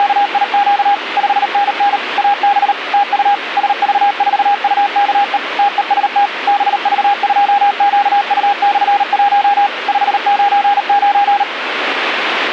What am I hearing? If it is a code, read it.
Morse code, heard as a keyed tone, machine-sent, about 38 wpm, 810 Hz, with radio static. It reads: … 5NN AB TU SV4UKE TEST BV2QU/1 599